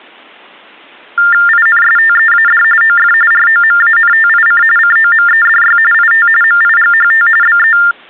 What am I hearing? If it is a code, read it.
TTY/TDD text telephone tones (45.45 baud Baudot), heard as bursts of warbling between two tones, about 400 Hz shift, 1600 Hz centre. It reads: INSTEAD OF ROMANTIC COMEDY IT MIGHT BE